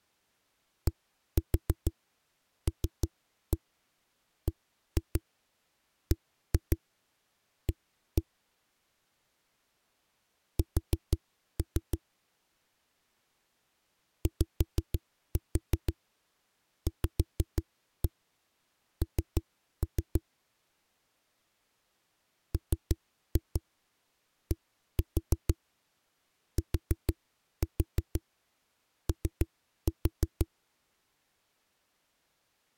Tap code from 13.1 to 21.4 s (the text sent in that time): YVN